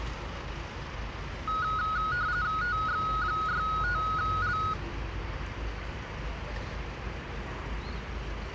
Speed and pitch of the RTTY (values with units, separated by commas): 45.45 baud, 170 Hz shift, 1360 Hz centre